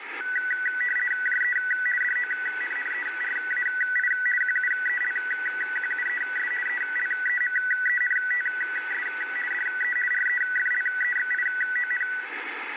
RTTY (50 baud, 450 Hz shift), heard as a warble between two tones, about 1750 Hz centre, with radio static. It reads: JE DONNERAI QUELQUES ELEMENTS DE REFLEXION